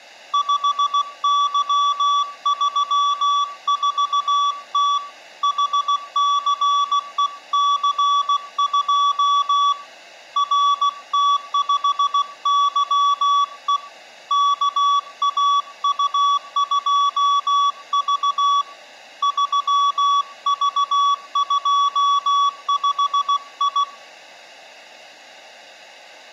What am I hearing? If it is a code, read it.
Morse code, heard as a keyed tone, hand-sent with a paddle, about 16 wpm, 1140 Hz, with room echo. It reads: 5Y34T HCEC2 RT5YE KAU2V 3V25I